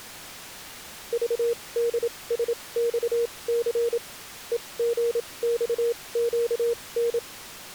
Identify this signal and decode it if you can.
Morse code, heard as a keyed tone, machine-sent, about 27 wpm, spaced as for 21 wpm, 470 Hz. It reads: VDSXC EGXQN